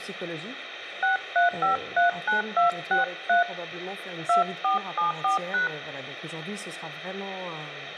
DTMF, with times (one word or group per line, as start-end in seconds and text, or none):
1.0-3.4 63539263
4.3-5.7 2474#